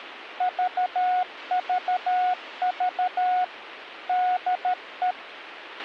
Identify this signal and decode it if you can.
Morse code, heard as a keyed tone, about 13 wpm, 730 Hz, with radio hiss and a squelch burst at the end. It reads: VVV DE